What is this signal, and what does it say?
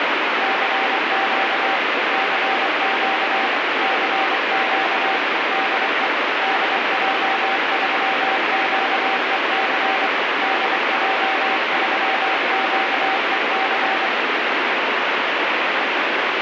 Morse code, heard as a keyed tone, machine-sent, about 24 wpm, 770 Hz, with heavy radio static. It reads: CQ CQ CQ DE DJ3QEC DJ3QEC